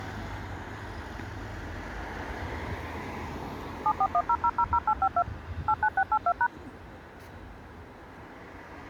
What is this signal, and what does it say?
DTMF, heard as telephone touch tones, dialled by machine, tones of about 60 ms, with street noise. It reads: 7410000852 89682#